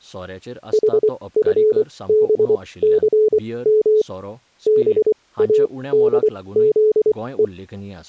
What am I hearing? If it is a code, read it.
Morse code, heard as a keyed tone, machine-sent, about 24 wpm, spaced as for 18 wpm, 430 Hz, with speech in Goan Konkani. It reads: HFBCM BADZE